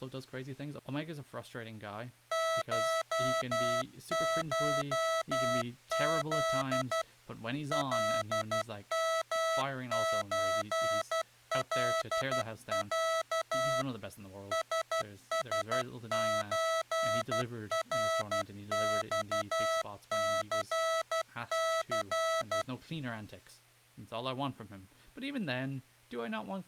Morse code (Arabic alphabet), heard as electronic beeps, machine-sent, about 12 wpm, 650 Hz, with speech in English. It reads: ششذ لمزلع سسزرصثث